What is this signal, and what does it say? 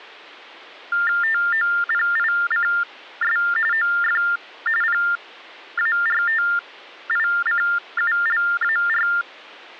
TTY/TDD text telephone tones (45.45 baud Baudot), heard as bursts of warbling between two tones, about 400 Hz shift, 1600 Hz centre. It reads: TOPICS OF PARTICULAR